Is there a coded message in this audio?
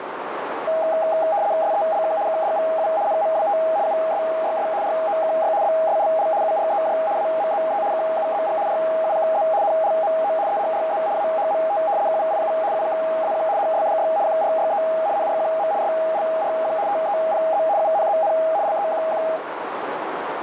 Yes: RTTY (75 baud, 170 Hz shift) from 0.7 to 19.4 s, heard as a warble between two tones, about 730 Hz centre, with radio static and a narrow filter. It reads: SELK KDVU NMWT USYS ROKY BSLL UREJ AMZE KUZG RUKZ NLMO EHRZ AHMT KVIU UKAQ HSDY QRYE NRQM SLRQ TEPZ UNZN LEQQ